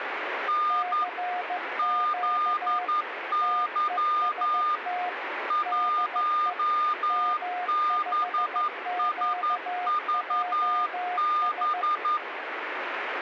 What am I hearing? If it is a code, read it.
Morse code, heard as two keyed tones, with radio static. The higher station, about 11 wpm, 1210 Hz: N ZY 1BSVB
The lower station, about 15 wpm, 720 Hz: CQ TEST DE M5QJS